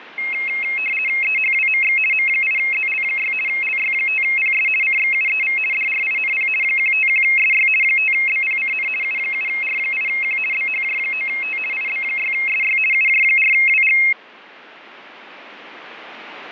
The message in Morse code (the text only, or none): none